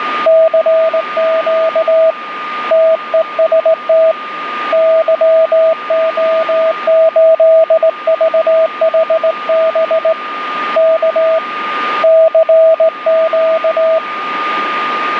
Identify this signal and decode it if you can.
Morse code, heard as a keyed tone, hand-sent with a straight key, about 18 wpm, 650 Hz, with radio static and a steady whistle near 1220 Hz. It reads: CQ TEST YO8VHB K CQ